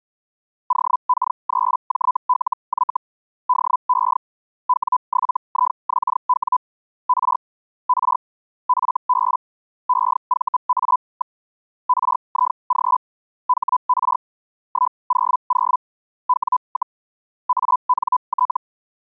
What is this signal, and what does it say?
Hellschreiber (Feld-Hell, 122.5 baud), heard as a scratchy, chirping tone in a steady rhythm, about 1000 Hz. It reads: OK3JLY DE W7IXW R R FB EVA. RIG HR 100 W, ANT